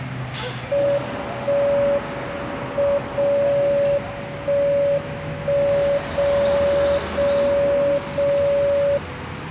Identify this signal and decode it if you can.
Radio time signal (WWVB), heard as a tone whose level steps once a second, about 570 Hz, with the noise of a residential street. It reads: 1 M 0 1 1 0 0 0